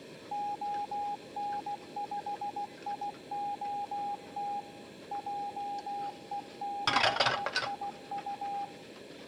Morse code, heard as a keyed tone, machine-sent, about 16 wpm, 810 Hz, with kitchen noise. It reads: ON5IOT JE6IU